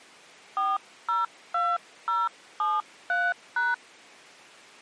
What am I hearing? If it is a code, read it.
DTMF, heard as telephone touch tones, dialled by hand, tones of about 200 ms. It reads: 402073#